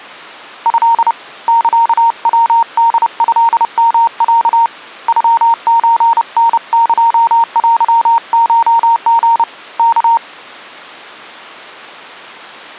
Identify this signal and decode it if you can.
Morse code (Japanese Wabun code), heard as a keyed tone, hand-sent with a paddle, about 30 wpm, 920 Hz. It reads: ト サヤホトヨロ ノソタエテコリ ワ